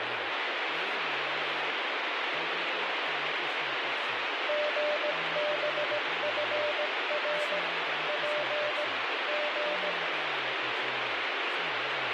Morse code, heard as a keyed tone, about 17 wpm, 600 Hz, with heavy radio static and speech in Bodo. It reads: GBFR P G